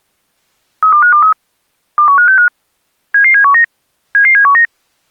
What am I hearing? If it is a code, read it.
Five-tone selective call (CCIR), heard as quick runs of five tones, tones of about 100 ms. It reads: 32523 21565 77719 77719